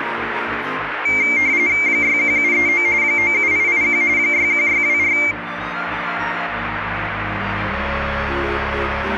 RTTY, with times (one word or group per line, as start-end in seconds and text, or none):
1.9-2.9 61739
3.0-4.0 97881
4.2-5.2 61624